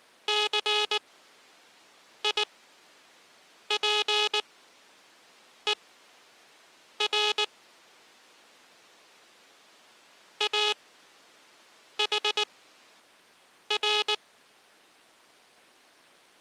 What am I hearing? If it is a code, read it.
Morse code (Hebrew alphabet), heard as a buzzer, machine-sent, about 19 wpm, spaced as for 6 wpm. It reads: סיפור אחר